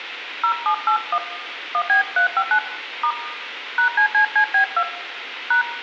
DTMF, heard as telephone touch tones, dialled by hand, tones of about 90 ms, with phone line noise and room echo. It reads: 0781 1B359 * #CCCB2 #